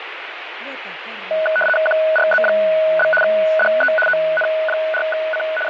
RTTY (75 baud, 850 Hz shift), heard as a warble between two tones, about 1060 Hz centre, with radio static. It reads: QRZ? DE ON4C …